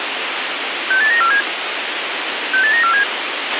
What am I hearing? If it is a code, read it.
Five-tone selective call (CCIR), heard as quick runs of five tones, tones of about 100 ms, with radio hiss and a squelch burst at the end. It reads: 68947 68947